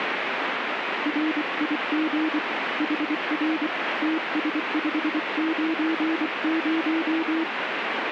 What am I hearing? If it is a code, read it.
Morse code, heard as a keyed tone, hand-sent with a paddle, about 24 wpm, 320 Hz, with radio static. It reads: RIG HR TS590